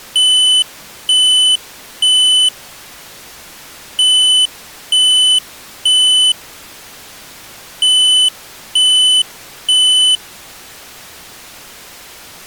Alarm pattern, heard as an alarm's beeps, played three times, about 3000 Hz. Temporal three. Smoke or fire, evacuate.